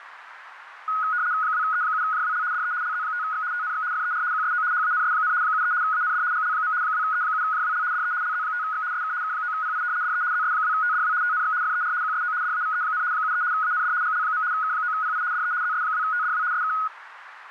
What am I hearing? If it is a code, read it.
RTTY (75 baud, 170 Hz shift), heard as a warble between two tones, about 1360 Hz centre, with radio static. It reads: 2E7JWL DE LZ5X TNX FER QSO HANS, 73 AND GL. 2E7JWL DE LZ5X SK K9PI DE ZS2TDW TNX FER QSO DAVE, 73 AND GL. K9PI DE ZS2TDW SK